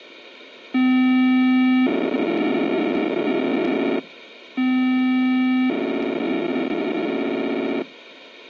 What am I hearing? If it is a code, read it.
POCSAG pager data (512 baud), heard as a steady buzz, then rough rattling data, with radio hiss and a squelch burst at the end.